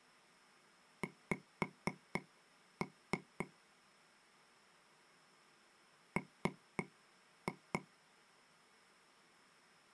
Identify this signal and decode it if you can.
Tap code, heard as taps on a table, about 3 knocks a second. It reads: X M